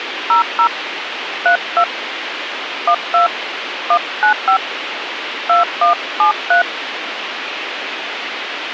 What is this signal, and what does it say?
DTMF, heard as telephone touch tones, dialled by hand, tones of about 110 ms, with radio hiss. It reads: 00 32 12 195 2173